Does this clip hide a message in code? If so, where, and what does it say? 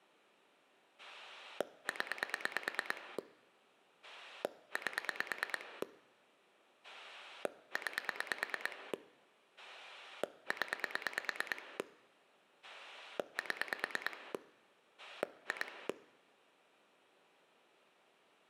Yes: pulse dialling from 1.0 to 15.9 s, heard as a rotary dial, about 9 pulses a second, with room echo. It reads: 0 8 9 0 7 2